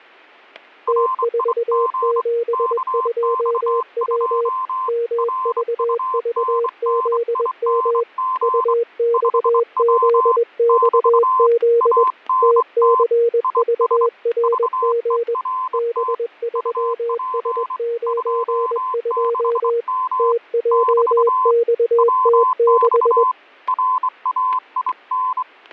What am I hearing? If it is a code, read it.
Morse code, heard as two keyed tones, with fading and static crashes. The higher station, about 24 wpm, 1030 Hz: RIG KX2 RUNNING 5W <BT> ANT IS VERT UP 26M <BT> WX RAIN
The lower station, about 21 wpm, 470 Hz: T472W MVVZM UXZXZ TCVRG B3S92 TJXT6